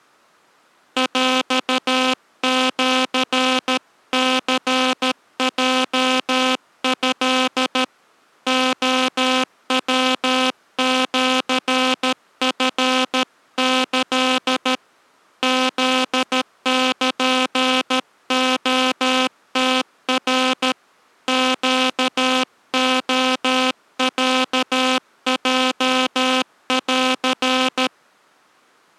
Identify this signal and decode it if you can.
Morse code (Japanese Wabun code), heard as a buzzer, hand-sent with a paddle, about 13 wpm. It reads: ヰシニヲト レヤシチキ フルレムナ ネレロヲン